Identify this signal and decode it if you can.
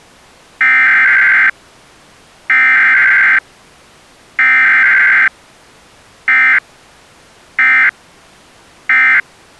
Emergency Alert System (SAME) tones (header bursts, then end-of-message bursts), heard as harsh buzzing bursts, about 520.83 baud.